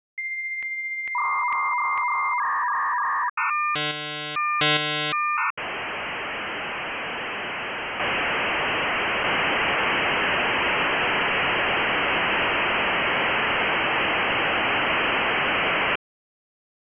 Dial-up modem handshake (V.34 or later), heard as a whistle, warbles, then hiss.